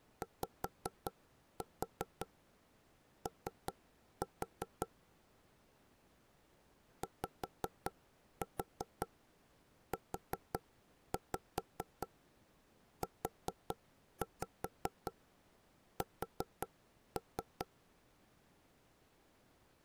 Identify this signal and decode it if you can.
Tap code, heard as knocks on wood, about 5 knocks a second. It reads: YO YUUS